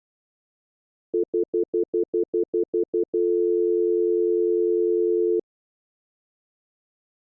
Telephone call progress tone (North American plan), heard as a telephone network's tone, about 350, 440 Hz, 0.1 s on and 0.1 s off. Stutter dial tone.